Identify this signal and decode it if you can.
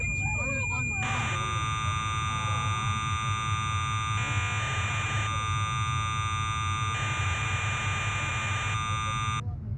Cassette data (Kansas City type), 1200 baud, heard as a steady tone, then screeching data, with the noise inside a car.